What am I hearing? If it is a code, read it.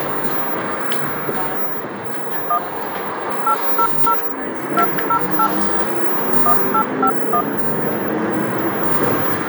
DTMF, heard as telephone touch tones, dialled by hand, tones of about 80 ms, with the noise inside a bus. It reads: 1 800 208 1851